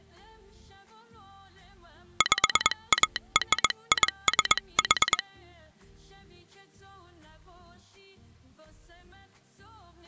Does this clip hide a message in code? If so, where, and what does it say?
Yes: Morse code (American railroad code) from 2.1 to 5.2 s, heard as a telegraph sounder. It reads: PARISH